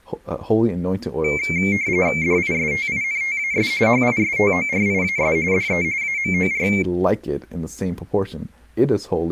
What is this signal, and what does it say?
RTTY (45.45 baud, 170 Hz shift), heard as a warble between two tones, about 2200 Hz centre, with speech in English. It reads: DISTINTAS HISTORIAS DE AMOR